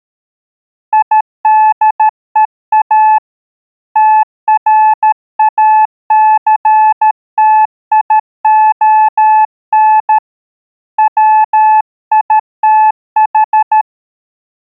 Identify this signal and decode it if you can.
Morse code, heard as a keyed tone, hand-sent with a paddle, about 13 wpm, 860 Hz. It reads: IDEA TRACTION WITH